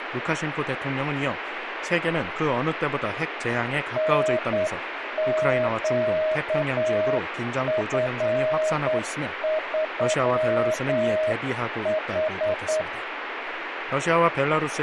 Morse code, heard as a keyed tone, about 9 wpm, 630 Hz, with radio static. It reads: NQF3H